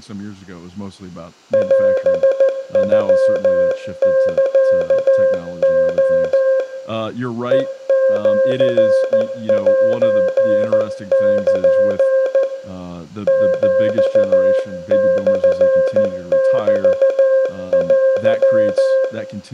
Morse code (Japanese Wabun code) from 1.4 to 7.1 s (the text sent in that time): オノサレ